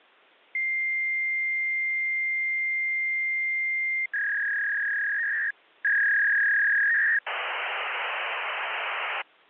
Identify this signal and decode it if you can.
Fax machine handshake, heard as a long tone, a warble and hiss.